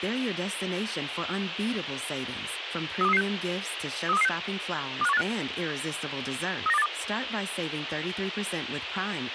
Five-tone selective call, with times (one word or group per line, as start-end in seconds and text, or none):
3.0-3.2 32336
4.1-4.3 32336
5.0-5.2 25185
6.7-6.9 39282